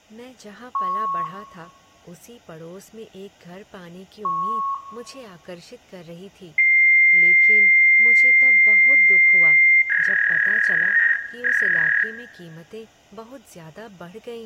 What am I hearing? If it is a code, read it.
Fax machine handshake, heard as beeps, a long tone and a warble, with room echo and speech in Hindi.